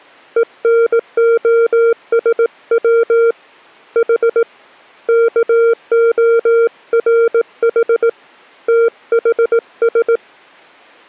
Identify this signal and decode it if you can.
Morse code (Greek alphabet), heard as a keyed tone, hand-sent with a bug key, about 18 wpm, 460 Hz. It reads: ΕΝΟΣΩ Η ΚΟΡΗ ΤΗΣ